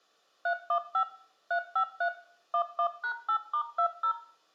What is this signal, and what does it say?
DTMF, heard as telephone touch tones, dialled by machine, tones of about 80 ms, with room echo. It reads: 315 353 11#8*20